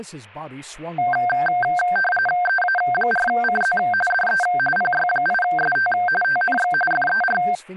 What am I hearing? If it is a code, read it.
RTTY (45.45 baud, 850 Hz shift), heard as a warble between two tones, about 1140 Hz centre, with speech in English. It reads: EA4CZ DE PY8ST TNX FER